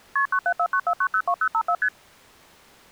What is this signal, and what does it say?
Multi-frequency trunk signalling (R1, as on North American trunks), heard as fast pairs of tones, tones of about 70 ms. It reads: KP 97494902054 ST